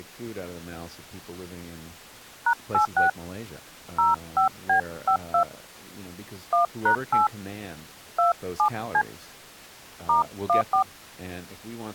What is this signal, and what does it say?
DTMF, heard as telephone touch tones, dialled by hand, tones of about 110 ms, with speech in English. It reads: #86 05B52 1#8 27C *14